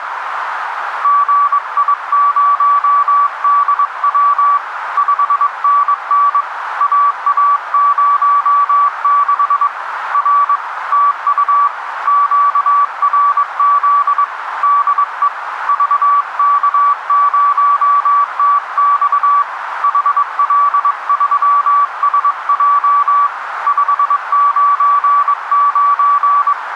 Morse code, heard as a keyed tone, hand-sent with a paddle, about 22 wpm, 1150 Hz, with radio static and a narrow filter. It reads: GI0DW 5NN AA06 R TU QRZ DE VK0TX HL3SJ 599